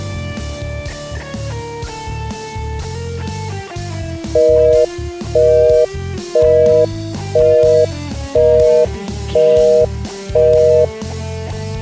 Telephone call progress tone (North American plan), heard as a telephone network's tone, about 480, 620 Hz, 0.5 s on and 0.5 s off. Busy tone.